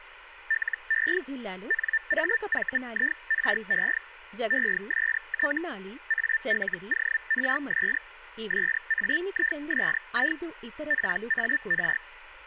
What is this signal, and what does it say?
Hellschreiber (Feld-Hell, 122.5 baud), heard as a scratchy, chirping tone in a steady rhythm, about 1800 Hz, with speech in Telugu. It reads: LE NAVIRE EST ALORS SAISI PAR